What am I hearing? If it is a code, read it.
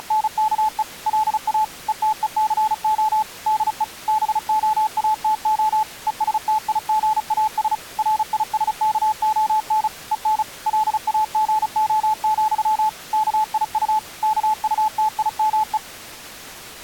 Morse code, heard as a keyed tone, machine-sent, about 35 wpm, 860 Hz. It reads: … LA ETECO DE BOATO ESTIGAS RISKON EN LAGO, KIU KUTIME